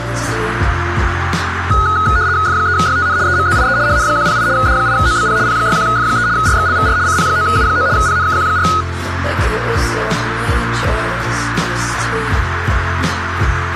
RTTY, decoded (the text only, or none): F3YTN EMZIE HN108 D8OBP P61F3 RXLVR CP9U9 PNKQ4